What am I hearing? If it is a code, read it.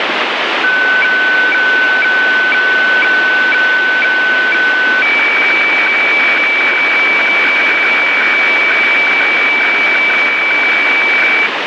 Weather fax (radiofax), 120 lines a minute, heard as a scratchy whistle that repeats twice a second, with radio static.